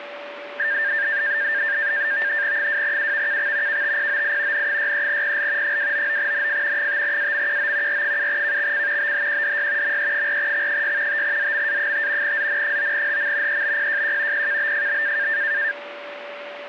NAVTEX (SITOR-B), 100 baud, 170 Hz shift, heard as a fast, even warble, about 1700 Hz centre, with radio static and a steady whistle near 580 Hz. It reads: 2UVKX KTPOI N63PL 299NF 5AMQO R7KXC BHQDY ME4X6 5ZMA5 ZN9HM EBPJQ PKBFB